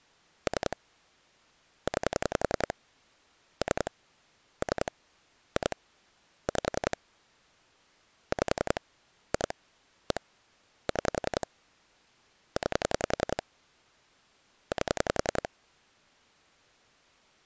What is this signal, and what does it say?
Pulse dialling, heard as clicks on a phone line, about 10 pulses a second. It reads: 3 9 3 3 2 5 5 2 1 6 9 8